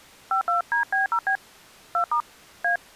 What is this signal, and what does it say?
DTMF, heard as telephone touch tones, dialled by hand, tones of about 100 ms. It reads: 52DB0B 2* A